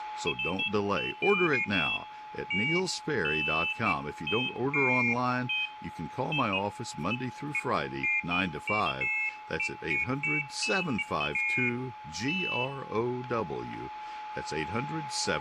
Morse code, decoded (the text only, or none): none